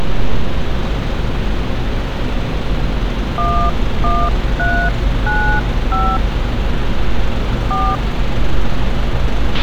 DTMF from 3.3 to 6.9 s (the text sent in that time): 11395